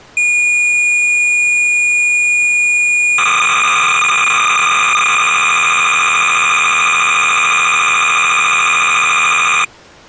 Cassette data (Kansas City type), 300 baud, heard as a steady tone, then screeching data.